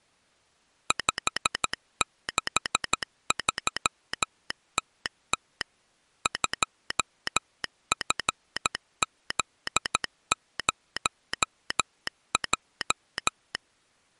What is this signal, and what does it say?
Morse code, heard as a telegraph sounder, machine-sent, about 13 wpm. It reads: 563TT 2FZ0J